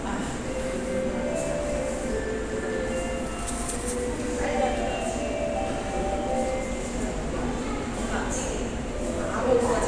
The noise of a subway station. There is no code.